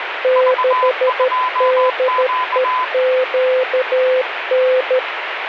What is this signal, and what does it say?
Morse code, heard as two keyed tones, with radio static. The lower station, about 13 wpm, 510 Hz: 6DEQN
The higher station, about 21 wpm, 1010 Hz: V2Q